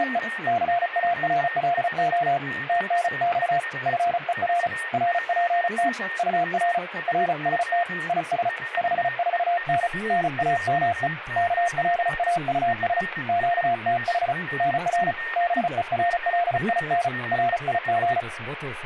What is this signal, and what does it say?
Morse code, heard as a keyed tone, hand-sent with a paddle, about 35 wpm, 700 Hz, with radio static, static crashes, a weaker station near 1840 Hz and speech in German. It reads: … CARLO TNX FER RPT UR RST IS 54N NAME KLAUS QTH NR BERLIN RIG